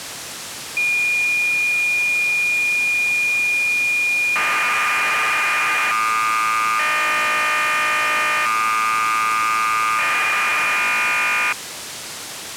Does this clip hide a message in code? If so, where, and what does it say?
Yes: cassette data (Kansas City type), 1200 baud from 0.8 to 11.5 s, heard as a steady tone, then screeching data, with tape hiss.